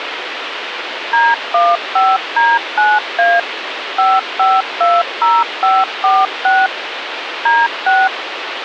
DTMF, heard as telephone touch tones, dialled by machine, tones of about 210 ms, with phone line noise. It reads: D15D9A 5520546 D6